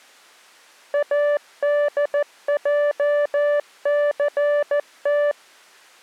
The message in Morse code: ADJCT

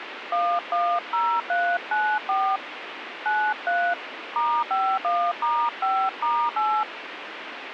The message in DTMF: 110394 93 *51*5*8

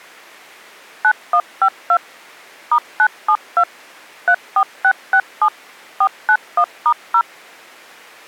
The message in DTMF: 9152 *972 34667 491*0

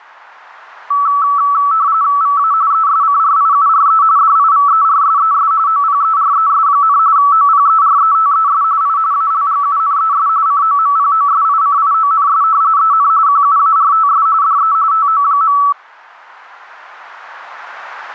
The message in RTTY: VA ESCRIURE DIVERSES OPERES, OPERETES I ALGUNES COMPOSICIONS EN QUARTS DE TO.

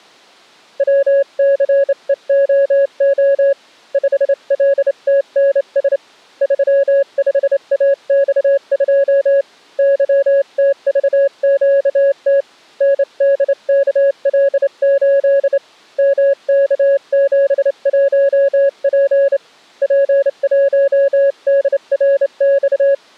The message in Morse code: WCEOO 5LTNS 35AX2 YTVQT NDKL8 MK71P P1DRX

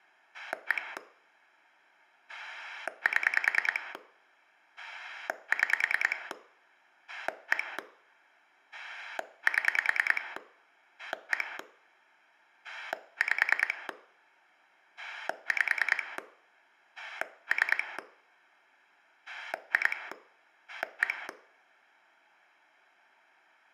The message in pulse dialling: 1 7 6 1 7 1 5 5 3 2 1

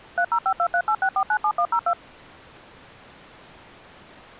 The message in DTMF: 3052386497102

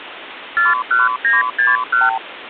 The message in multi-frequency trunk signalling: 41961

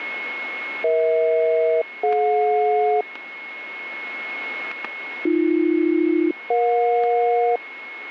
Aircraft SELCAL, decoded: EH-DJ AB-EJ

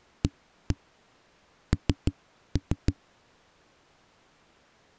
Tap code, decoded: AN

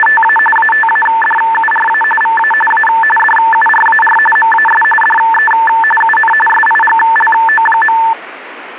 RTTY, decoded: … ATADURA VA A DURAR MAS DE UN SIGLO.

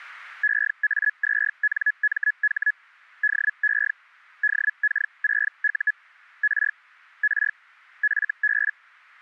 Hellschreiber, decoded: EA2NMH DE DK6U R R FB

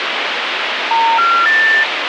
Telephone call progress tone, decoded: special information tone

